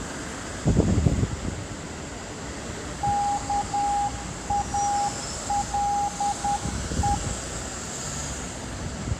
Morse code (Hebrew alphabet), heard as a keyed tone, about 10 wpm, 810 Hz, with street noise. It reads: כאלו